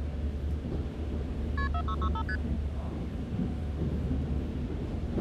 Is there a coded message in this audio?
Yes: multi-frequency trunk signalling (R1, as on North American trunks) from 1.6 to 2.4 s, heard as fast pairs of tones, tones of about 70 ms, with the noise inside a subway train. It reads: KP 4665 ST